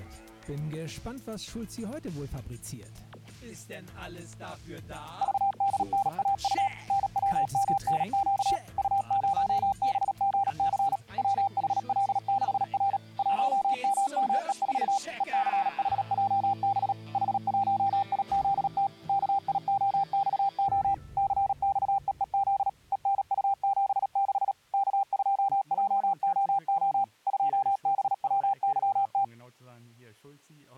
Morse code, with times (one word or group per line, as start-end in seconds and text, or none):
5.2-6.7 VDNAU
6.9-8.6 NWMNQ
8.8-11.0 U0BGC
11.2-13.0 WHL6R
13.2-15.0 1MME4
15.2-16.9 ECHJB
17.1-18.9 H1IZT
19.1-20.9 KIOXO
21.2-22.7 CXEEZ
22.9-24.5 ENU76
24.7-27.0 K2JOO
27.3-29.2 2BWYT